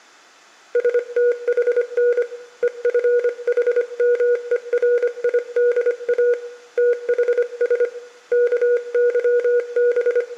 Morse code (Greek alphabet), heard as a keyed tone, hand-sent with a paddle, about 25 wpm, 480 Hz, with room echo. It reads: ΣΤΗΝ ΕΦΗΜΕΡΙΔΑ ΤΗΣ …